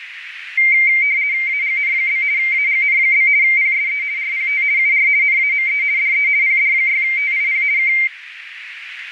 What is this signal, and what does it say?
RTTY (50 baud, 170 Hz shift), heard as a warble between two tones, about 2200 Hz centre, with radio static and a narrow filter. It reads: AGN? AGN? PSE RPT UR NAME DE PD6TIP K